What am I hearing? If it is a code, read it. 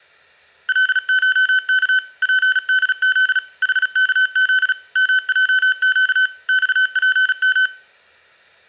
Morse code (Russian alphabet), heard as electronic beeps, machine-sent, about 36 wpm, 1500 Hz, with room echo. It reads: ЛШК ПДЗ ХКЗ МЙЩ ЬПМ